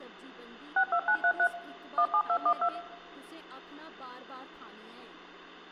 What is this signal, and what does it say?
DTMF, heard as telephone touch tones, dialled by machine, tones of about 80 ms, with hum, room echo and speech in Dogri. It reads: 62933 17212